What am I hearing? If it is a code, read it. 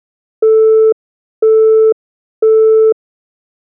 Telephone call progress tone (single-tone plan, as in Europe, Japan and elsewhere), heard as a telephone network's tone, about 440 Hz, 0.5 s on and 0.5 s off. Busy tone.